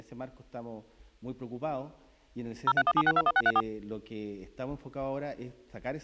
DTMF, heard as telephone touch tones, dialled by machine, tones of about 50 ms. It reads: 0317621634